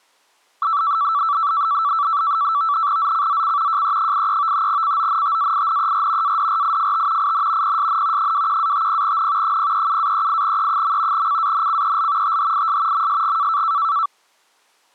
NAVTEX (SITOR-B), 100 baud, 170 Hz shift, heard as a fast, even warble, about 1240 Hz centre. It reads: ZCZC JE83 CONTAINER ADRIFT IN PSN 21-50N 037-38E. CANCEL THIS MSG